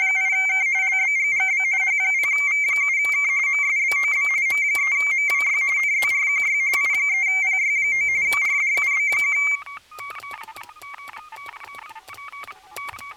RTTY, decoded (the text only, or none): … LBGGB H0V7K MSBOB M3MWY NZRQY I3PY9 RDUB1